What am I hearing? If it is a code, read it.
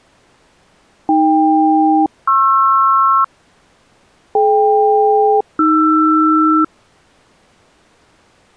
Aircraft SELCAL, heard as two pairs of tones. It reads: AK-PR DK-AR